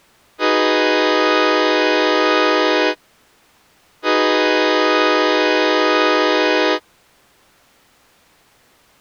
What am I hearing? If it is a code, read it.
Train horn signal, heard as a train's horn. 2 long. On North American railways: brakes released, proceed.